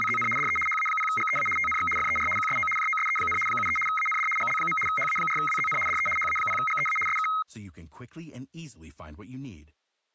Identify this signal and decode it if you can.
RTTY (75 baud, 850 Hz shift), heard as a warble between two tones, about 1700 Hz centre, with speech in English. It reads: … DE HA0GEA TNX FER QSO JOSE, 73 AND GL. HA4WZN DE HA0GEA SK